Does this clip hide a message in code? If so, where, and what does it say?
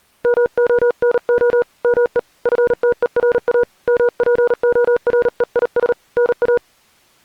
Yes: Morse code (Greek alphabet) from 0.2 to 6.6 s, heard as a keyed tone, hand-sent with a paddle, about 38 wpm, 480 Hz. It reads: ΜΟΝΟ ΜΕ ΦΤΕΡΑ ΜΠΟΡΕΙΣ ΝΑ